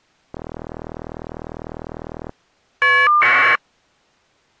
Caller ID data burst, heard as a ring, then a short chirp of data, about 1200 baud.